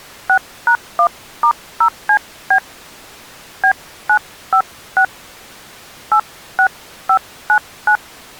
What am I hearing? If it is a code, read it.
DTMF, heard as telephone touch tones, dialled by hand, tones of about 80 ms. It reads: 6#1*0CB B956 86599